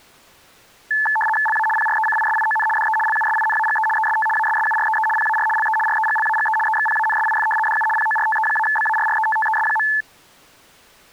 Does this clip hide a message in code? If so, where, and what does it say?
Yes: RTTY (75 baud, 850 Hz shift) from 0.9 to 10.0 s, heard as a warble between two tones, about 1300 Hz centre. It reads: LA PRECISION DE LUSINAGE EST ASSUREE PAR LE REGLAGE EXPANSIF DU PORTE-BARRETTES.